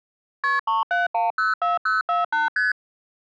Multi-frequency trunk signalling (R1, as on North American trunks), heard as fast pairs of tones, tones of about 160 ms. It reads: KP 37104048 ST